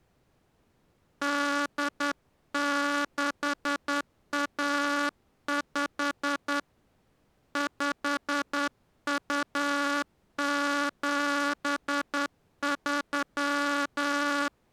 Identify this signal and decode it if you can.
Morse code (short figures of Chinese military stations), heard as a buzzer, hand-sent with a straight key, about 10 wpm. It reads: 8615 5273